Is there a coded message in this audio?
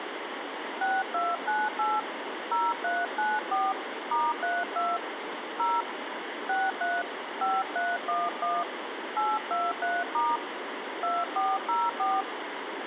Yes: DTMF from 0.8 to 12.2 s, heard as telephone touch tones, dialled by hand, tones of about 210 ms, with phone line noise. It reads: 6298 0394 *32 0 63 5311 823* 2404